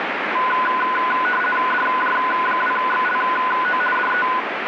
RTTY (50 baud, 450 Hz shift), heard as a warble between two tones, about 1240 Hz centre, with radio static. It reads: DJ2XLO DE